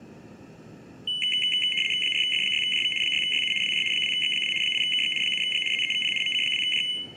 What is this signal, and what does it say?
RTTY (75 baud, 850 Hz shift), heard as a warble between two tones, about 2550 Hz centre, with room echo. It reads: 4F6JV 6YU WJ 2X2 8KX 7G ZEVP MC2J